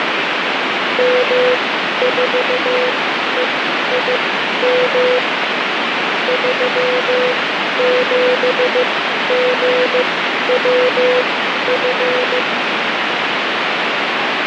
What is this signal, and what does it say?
Morse code, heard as a keyed tone, machine-sent, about 15 wpm, spaced as for 11 wpm, 500 Hz, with heavy radio static. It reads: M4EIM 37GWF